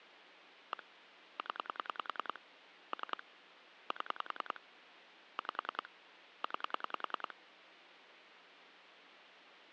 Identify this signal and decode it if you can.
Pulse dialling, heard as clicks on a phone line, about 10 pulses a second, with phone line noise. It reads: 1 0 3 7 5 9